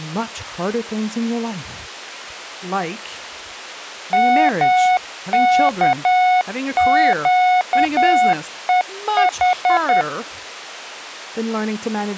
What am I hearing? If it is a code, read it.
Morse code, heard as a keyed tone, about 10 wpm, 730 Hz, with speech in English. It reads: MKQEH